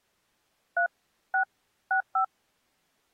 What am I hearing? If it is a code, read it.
DTMF, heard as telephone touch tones, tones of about 100 ms. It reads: 3 6 65